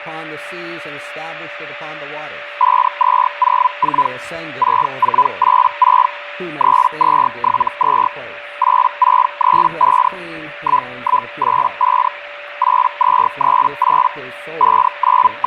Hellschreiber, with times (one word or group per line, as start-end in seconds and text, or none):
2.6-4.1 5204
4.6-6.1 6486
6.6-8.1 3272
8.6-10.1 8635
10.6-12.1 1185
12.6-14.1 8238
14.6-15.5 …